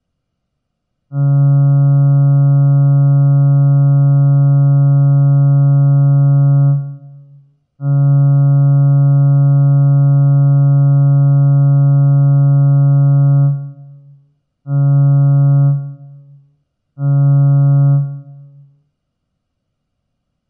Ship horn signal, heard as a ship's horn, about 140 Hz, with room echo. 2 long, 2 short. At sea: I intend to overtake on your port side.